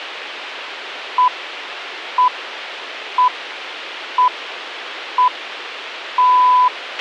Radio time signal (six pips, as the Greenwich Time Signal), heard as pips, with a squelch burst at the end.